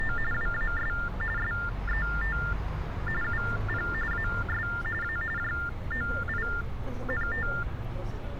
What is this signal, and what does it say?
TTY/TDD text telephone tones (45.45 baud Baudot), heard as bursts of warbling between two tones, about 400 Hz shift, 1600 Hz centre, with street noise. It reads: … WAS SET UP AS A JOINT